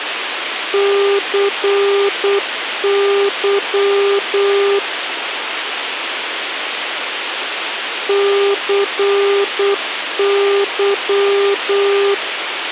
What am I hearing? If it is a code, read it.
Morse code, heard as a keyed tone, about 8 wpm, 400 Hz, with radio hiss. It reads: CY CY